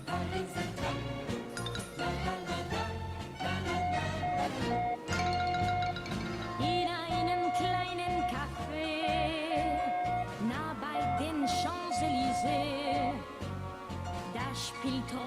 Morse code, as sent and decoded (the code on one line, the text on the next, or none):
...- .-. .- ..-.
VRAF